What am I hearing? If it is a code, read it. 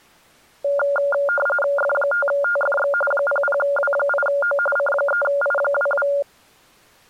RTTY (45.45 baud, 850 Hz shift), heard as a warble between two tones, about 990 Hz centre. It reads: F5TFX 00W8O C3I22